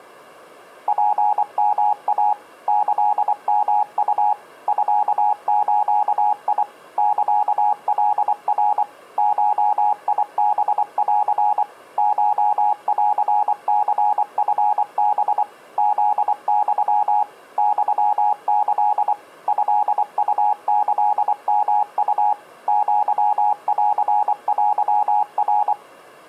Morse code (Japanese Wabun code), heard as a keyed tone, machine-sent, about 24 wpm, 830 Hz. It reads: ツヨイ キヨウ ミズ サカナ ゴハン コンニチハ フユ ユキ トウキヨウ アンテナ